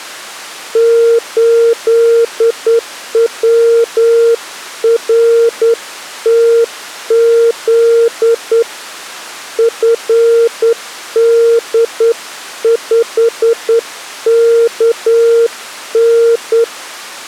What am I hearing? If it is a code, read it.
Morse code, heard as a keyed tone, hand-sent with a straight key, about 9 wpm, 460 Hz. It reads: 8WRTZ FD5KN